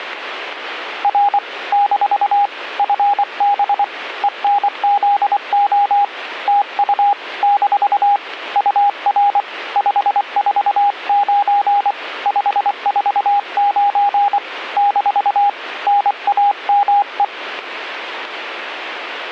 Morse code, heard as a keyed tone, hand-sent with a paddle, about 24 wpm, 810 Hz. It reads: R - FB ENZO TU - UR 549 549 - NAME